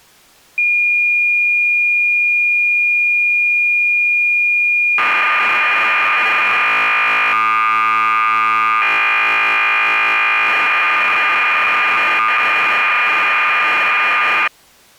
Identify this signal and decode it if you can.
Cassette data (Kansas City type), 1200 baud, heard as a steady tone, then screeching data.